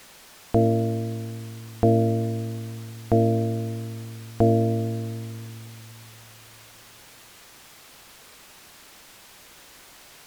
Clock strike, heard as a bell. 4. Four o'clock.